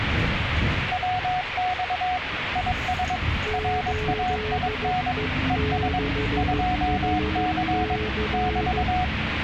Morse code, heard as two keyed tones, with radio static and the noise inside a bus. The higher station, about 22 wpm, 730 Hz: WX IS RAIN ES 2C <BT>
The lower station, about 14 wpm, 430 Hz: 8E6HC